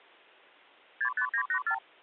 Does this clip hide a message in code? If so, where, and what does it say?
Yes: multi-frequency trunk signalling (R2, with the far end's replies) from 1.0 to 1.8 s, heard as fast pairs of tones, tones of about 80 ms. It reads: 65984